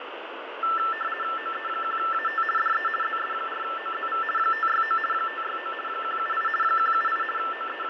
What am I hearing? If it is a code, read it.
RTTY (50 baud, 450 Hz shift), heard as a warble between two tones, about 1550 Hz centre, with radio static and fading. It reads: OE1AT DE ZS4OZV 569 569 178 178 …